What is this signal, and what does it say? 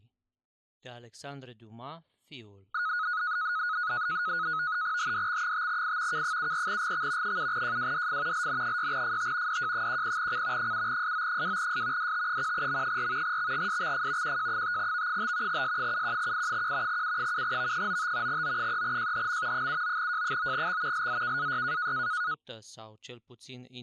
NAVTEX (SITOR-B), 100 baud, 170 Hz shift, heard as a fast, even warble, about 1360 Hz centre, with speech in Romanian. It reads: HDX5I K74GX 7JWDF LN6FT DJ10C 7SO2S DT1M4 XGSXF QJ5V5 S71I1 U7V95 O3JHM 79J9X LZKAY